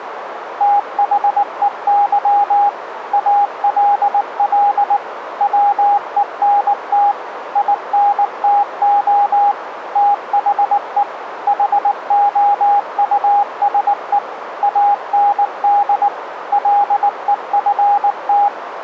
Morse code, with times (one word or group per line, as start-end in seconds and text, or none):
0.6-2.7 THEY
3.1-5.0 ALL
5.4-7.1 WENT
7.6-9.5 INTO
10.0-11.0 THE
11.5-14.2 HOUSE
14.6-16.1 AND
16.5-18.5 LEFT